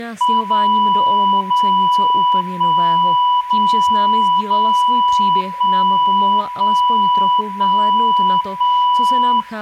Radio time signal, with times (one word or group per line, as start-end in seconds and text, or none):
0.4-1.4 0
1.4-2.4 0
2.4-3.4 1
3.4-4.4 0
4.4-5.4 0
5.4-6.4 1
6.4-7.4 1
7.4-8.4 1
8.4-9.4 1